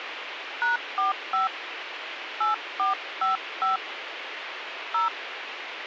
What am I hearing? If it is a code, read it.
DTMF, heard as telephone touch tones, dialled by hand, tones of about 140 ms, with radio hiss. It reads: #45 8455 0